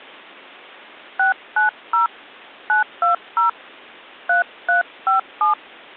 DTMF, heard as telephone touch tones, dialled by hand, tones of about 130 ms. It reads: 690 920 3357